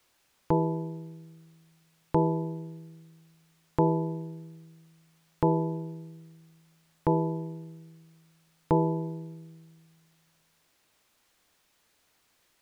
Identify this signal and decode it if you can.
Clock strike, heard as a bell. 6. Six o'clock.